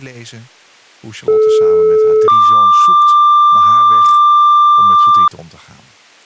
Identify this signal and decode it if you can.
Two-tone page, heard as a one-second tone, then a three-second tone, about 430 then 1180 Hz, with speech in Dutch.